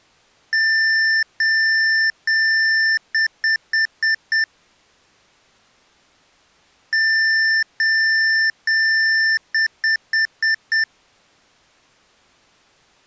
Beep code, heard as beeps from a small speaker, played twice, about 1800 Hz. 3 long, 5 short.